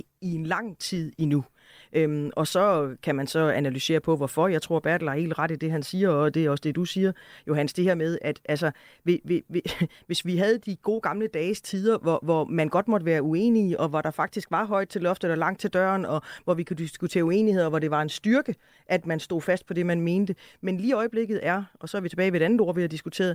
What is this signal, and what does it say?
Speech in Danish. There is no code.